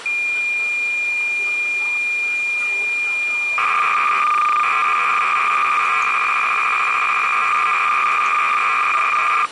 Cassette data (Kansas City type), 300 baud, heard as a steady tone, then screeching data, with the noise of a crowd indoors.